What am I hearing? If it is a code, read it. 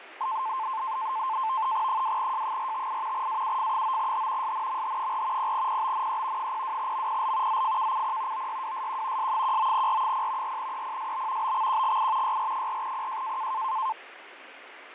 NAVTEX (SITOR-B), 100 baud, 170 Hz shift, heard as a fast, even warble, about 970 Hz centre, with radio static and fading. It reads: 2J458 AUF9H SNMH4 0PBNE 02MPL ZFKCP OYWSQ S19R0 4EPSB BXQGI YR4PJ